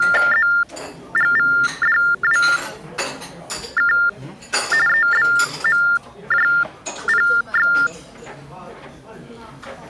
TTY/TDD text telephone tones (45.45 baud Baudot), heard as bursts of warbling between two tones, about 400 Hz shift, 1600 Hz centre, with the noise of a restaurant. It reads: ZGVDWK EBMJPX